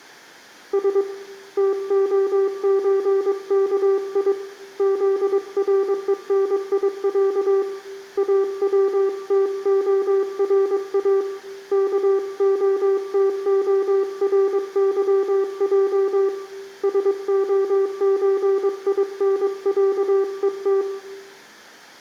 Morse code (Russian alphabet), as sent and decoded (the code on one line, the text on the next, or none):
... / - --- ---. -.- .. / --.. .-. . -. .. .-.- / .- .-- - --- .-. .- / -.- --- - --- .-. -.-- .--- / ... --- ---. .. -. .-.- . -
С ТОЧКИ ЗРЕНИЯ АВТОРА КОТОРЫЙ СОЧИНЯЕТ